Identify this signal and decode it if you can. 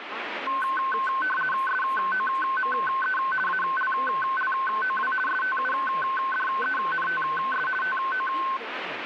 RTTY (50 baud, 450 Hz shift), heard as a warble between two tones, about 1290 Hz centre, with radio static and speech in Hindi. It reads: SOME ALLOW STUDENTS TO